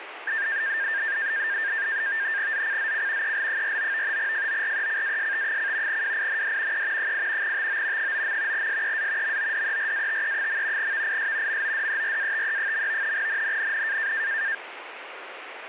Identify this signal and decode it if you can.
NAVTEX (SITOR-B), 100 baud, 170 Hz shift, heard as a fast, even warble, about 1700 Hz centre, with radio static. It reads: ZCZC EL49 FORECAST: WIND E 8 TO 9. SEA MODERATE. VIS MODERATE. NNNN